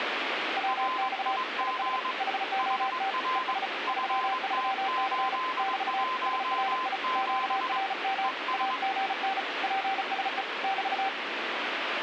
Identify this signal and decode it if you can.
Morse code, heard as two keyed tones, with radio static. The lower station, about 35 wpm, 780 Hz: WX IS HOT ES 33C <BT> SRI QRM AGN PSE <BT>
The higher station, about 22 wpm, 1030 Hz: RIG HR FT817 ES